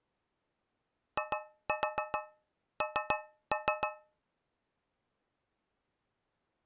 Tap code, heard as taps on a metal pipe, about 7 knocks a second. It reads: IN